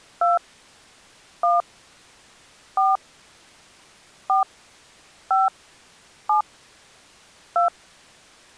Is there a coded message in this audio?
Yes: DTMF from 0.2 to 7.7 s, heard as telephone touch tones, dialled by hand, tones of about 160 ms. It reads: 2 1 4 4 5 7 2